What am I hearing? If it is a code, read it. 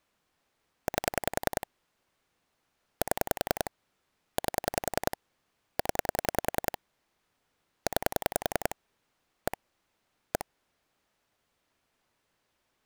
Pulse dialling, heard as clicks on a phone line, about 10 pulses a second. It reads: 8 7 8 0 9 1 1